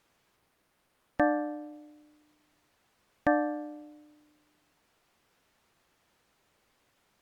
Clock strike, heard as a bell. 2. Two o'clock.